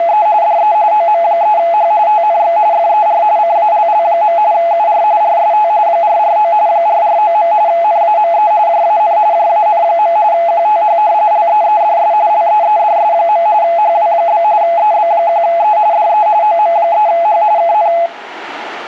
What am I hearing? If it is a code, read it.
RTTY (45.45 baud, 170 Hz shift), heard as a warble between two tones, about 760 Hz centre, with radio static. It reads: … DE OM3H TNX FER CALL. UR RST 449 449. NAME JAN JAN. QTH LEEDS LEEDS. HW? EB1E DE OM3H KN